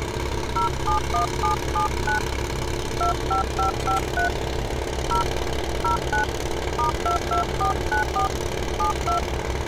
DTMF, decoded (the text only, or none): 071779 25553 0 09 *22494 72